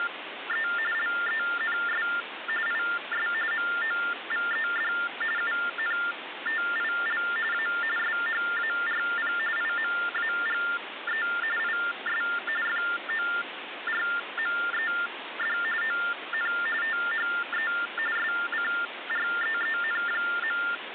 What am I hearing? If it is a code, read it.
TTY/TDD text telephone tones (45.45 baud Baudot), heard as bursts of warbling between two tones, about 400 Hz shift, 1600 Hz centre, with phone line noise. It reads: … LENS IS MOVED UNTIL A SHARP IMAGE IS FORMED ON THE SCREEN.